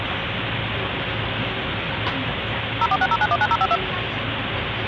DTMF, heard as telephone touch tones, dialled by machine, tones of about 50 ms, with phone line noise and the noise inside a bus. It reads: 0460919052